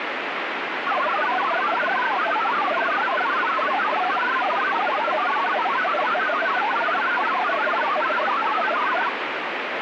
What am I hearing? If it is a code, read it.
Multi-tone FSK (Olivia or MFSK type), about 1000 Hz wide, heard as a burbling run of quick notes, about 62.5 baud, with heavy radio static.